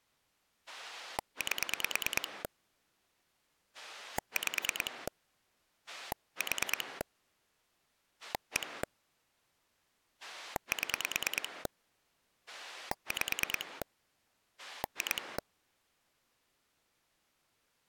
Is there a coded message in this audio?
Yes: pulse dialling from 0.7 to 15.4 s, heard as a rotary dial, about 9 pulses a second. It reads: 8 5 4 1 7 5 2